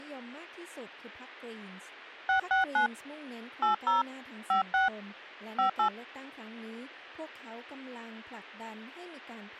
DTMF, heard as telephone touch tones, dialled by hand, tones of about 120 ms, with speech in Thai. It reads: 669 80 56 58